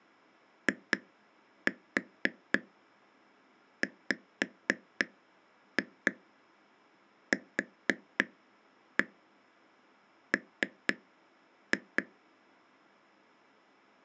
Tap code, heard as taps on a table, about 4 knocks a second. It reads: IWQM